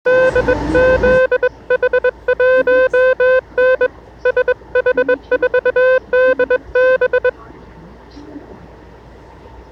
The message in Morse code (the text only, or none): DZH1N SH4DB